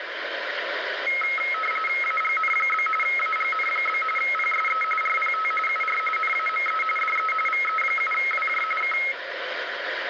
RTTY (45.45 baud, 850 Hz shift), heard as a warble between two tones, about 1700 Hz centre, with radio static. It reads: AGN? AGN? PSE RPT UR NAME DE VE7WJ K